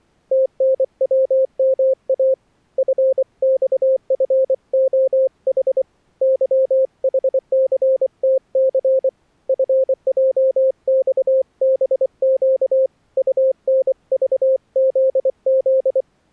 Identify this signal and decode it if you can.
Morse code, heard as a keyed tone, hand-sent with a paddle, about 24 wpm, 530 Hz. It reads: TNWMA FXFOH YHCTC FJXBQ UNVZZ